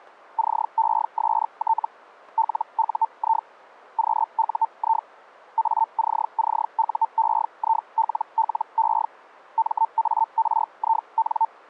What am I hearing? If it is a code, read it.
Hellschreiber (Feld-Hell, 122.5 baud), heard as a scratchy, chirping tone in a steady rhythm, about 900 Hz. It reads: CEST LUI QUI ACCUEILLE MARIN